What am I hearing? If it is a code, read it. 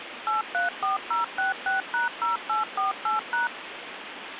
DTMF, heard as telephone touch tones, dialled by machine, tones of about 140 ms, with phone line noise. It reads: 834066#0848#